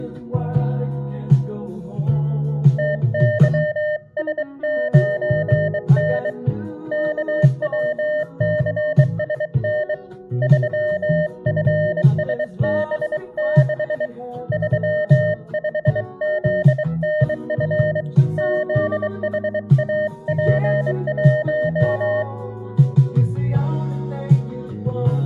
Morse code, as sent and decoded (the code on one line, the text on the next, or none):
- -.-- ... ----. -. / -.- .-- -.-. ... -. / ...-- ..-. ... -... -.... / ...-- ..... --.. -. ..-. / --.. .... .- .--. .----
TYS9N KWCSN 3FSB6 35ZNF ZHAP1